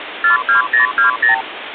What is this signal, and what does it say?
Multi-frequency trunk signalling (R2, with the far end's replies), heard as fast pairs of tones, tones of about 120 ms, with phone line noise. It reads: 42020